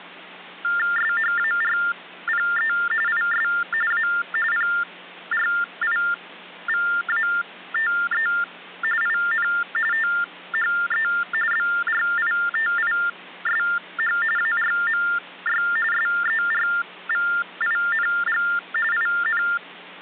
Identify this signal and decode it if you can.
TTY/TDD text telephone tones (45.45 baud Baudot), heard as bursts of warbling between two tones, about 400 Hz shift, 1600 Hz centre. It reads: SHARPE IS A PRIVATE IN THE BRITISH ARMY SERVING IN